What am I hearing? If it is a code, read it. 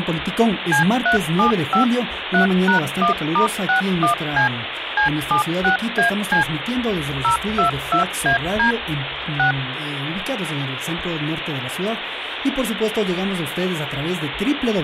DTMF, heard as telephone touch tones, dialled by machine, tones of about 110 ms, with phone line noise. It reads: C375 3#1*61C C76AC 022AD 6